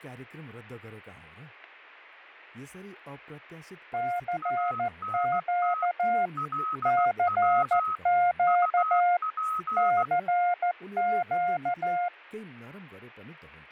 Morse code, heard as two keyed tones, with speech in Nepali. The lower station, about 14 wpm, 710 Hz: CQ CQ CQ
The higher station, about 16 wpm, 1280 Hz: ANT LW UP